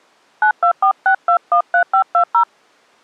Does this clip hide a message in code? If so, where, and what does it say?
Yes: DTMF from 0.4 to 2.4 s, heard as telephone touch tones, dialled by hand, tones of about 90 ms. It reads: 9246213520